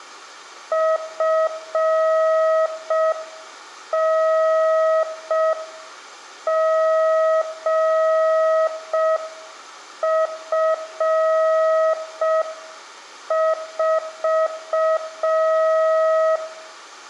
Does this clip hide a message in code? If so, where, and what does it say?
Yes: Morse code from 0.7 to 16.4 s, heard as a keyed tone, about 5 wpm, 640 Hz, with room echo. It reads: FNGF4